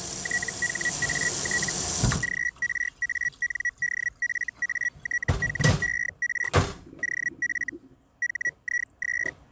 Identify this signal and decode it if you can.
Hellschreiber (Feld-Hell, 122.5 baud), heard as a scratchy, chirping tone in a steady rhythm, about 1950 Hz, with kitchen noise. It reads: THAT GRANDFATHER OF HIS